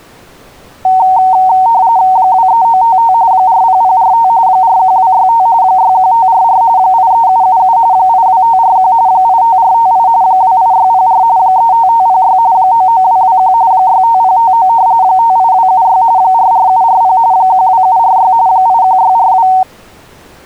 RTTY (45.45 baud, 170 Hz shift), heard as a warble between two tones, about 840 Hz centre. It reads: 23955 40045 41265 61544 83777 82541 85458 28604 35506 99221 65059 58276 44740 12746 81642